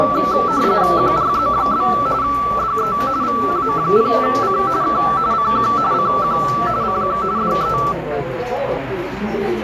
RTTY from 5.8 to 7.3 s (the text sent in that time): CQ CQ